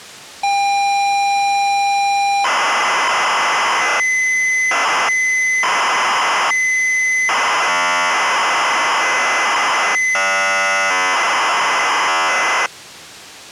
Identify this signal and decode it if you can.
ZX Spectrum tape loading, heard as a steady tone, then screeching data.